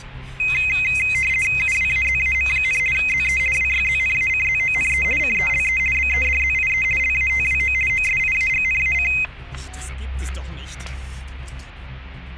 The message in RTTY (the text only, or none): UWAZAM, ZE WYZNACZONE CELE BEDZIE LATWO OSIAGNAC